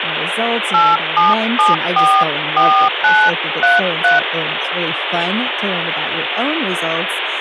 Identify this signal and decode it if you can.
DTMF, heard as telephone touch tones, dialled by hand, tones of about 240 ms, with phone line noise and speech in English. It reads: 87744933